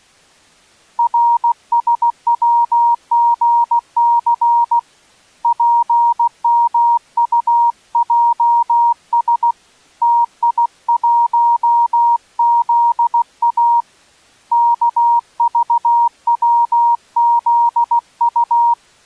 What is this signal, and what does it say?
Morse code, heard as a keyed tone, hand-sent with a paddle, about 16 wpm, 940 Hz. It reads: RSWGC PMUJS TI1ZA KVWZU